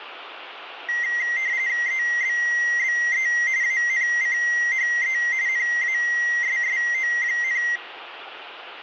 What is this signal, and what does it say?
RTTY (45.45 baud, 170 Hz shift), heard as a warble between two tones, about 2000 Hz centre, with radio static and room echo. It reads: EBBE ANCHE NASSO,